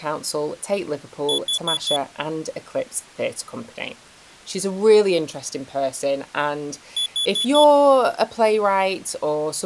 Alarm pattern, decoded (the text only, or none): temporal four